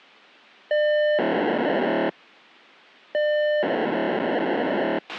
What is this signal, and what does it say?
POCSAG pager data (1200 baud), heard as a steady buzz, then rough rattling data, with a squelch burst at the end.